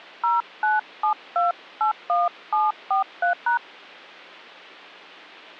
DTMF, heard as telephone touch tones, dialled by hand, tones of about 130 ms. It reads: 097281743#